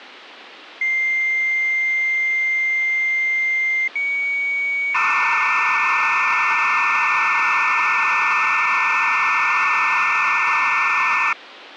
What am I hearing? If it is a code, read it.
Dial-up modem handshake (low-speed, two carriers), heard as two whistles, then hiss, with phone line noise.